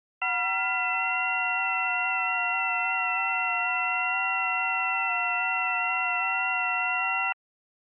FT8 (several signals at once), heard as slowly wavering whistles, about 6.25 baud.